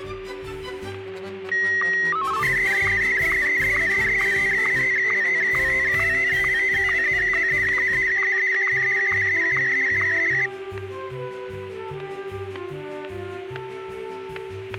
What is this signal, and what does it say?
SSTV (slow-scan television), Martin M1, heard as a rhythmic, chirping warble, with static crashes and a steady whistle near 380 Hz.